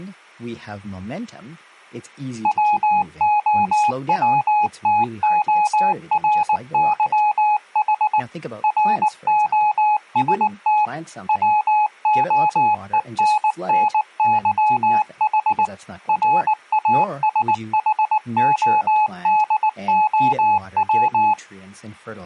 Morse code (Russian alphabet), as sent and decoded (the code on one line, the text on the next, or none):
.-- --- .-- - --- .-. -.-- .... / .-. --- ... - / .-- --- . -. -. -.-- .... / .-. .- ... .... --- -.. --- .--
ВОВТОРЫХ РОСТ ВОЕННЫХ РАСХОДОВ